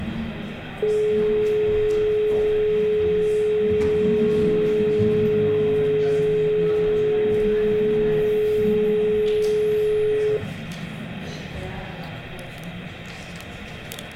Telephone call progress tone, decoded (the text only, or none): dial tone